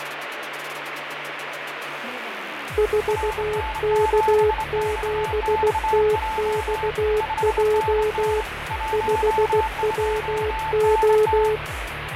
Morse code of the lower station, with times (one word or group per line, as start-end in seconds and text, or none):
2.8-8.4 4K7TXJ
8.9-11.6 5WO